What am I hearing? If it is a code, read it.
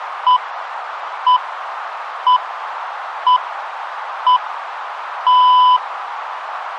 Radio time signal (six pips, as the Greenwich Time Signal), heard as pips, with radio static and a narrow filter.